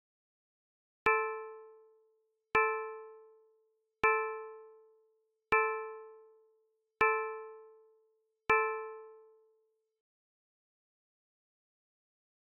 Clock strike, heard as a bell. 6. Six o'clock.